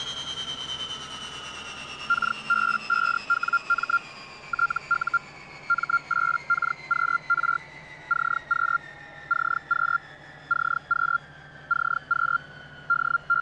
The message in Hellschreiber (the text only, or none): KB5WM TU M8KQR CQ CQ CQ CQ …